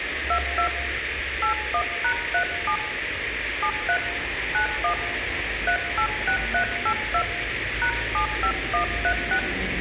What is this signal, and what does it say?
DTMF, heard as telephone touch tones, dialled by hand, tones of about 90 ms, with radio hiss and street noise. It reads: 22 81#37 73 91 386382 #75136